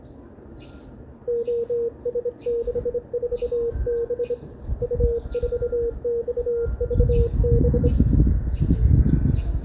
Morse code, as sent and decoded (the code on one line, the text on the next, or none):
--- ... -.... ....- -... / ..- ....- -..- ...- -...
OS64B U4XVB